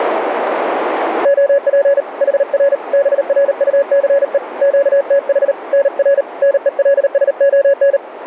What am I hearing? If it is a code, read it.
Morse code, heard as a keyed tone, hand-sent with a paddle, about 38 wpm, 560 Hz, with radio static. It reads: OP HR BRUCE QTH NR NELSON